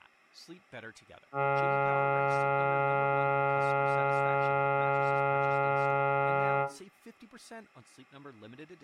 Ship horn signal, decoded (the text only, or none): 1 long